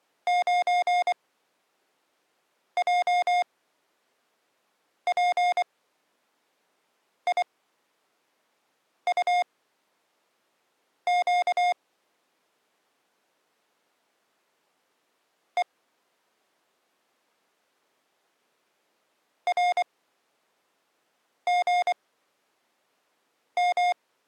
Morse code, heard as electronic beeps, machine-sent, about 24 wpm, spaced as for 5 wpm, 710 Hz. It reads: 9JPIUQ E RGM